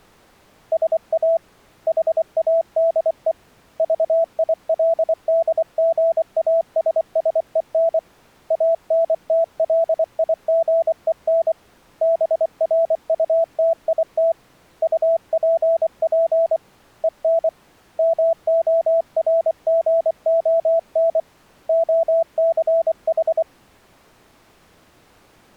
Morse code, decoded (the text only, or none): SA HADE VILDGASSEN ANTLIGEN BRUTIT UPP EN MORGON OCH